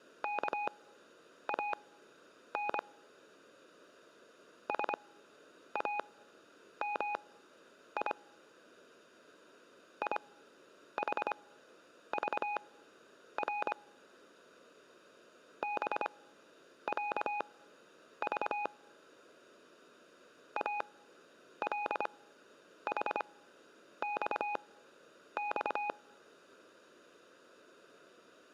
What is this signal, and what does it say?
Morse code (Arabic alphabet), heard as a keyed tone, machine-sent, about 25 wpm, spaced as for 9 wpm, 830 Hz, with room echo. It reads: كان سامي يحضر بعض الحصص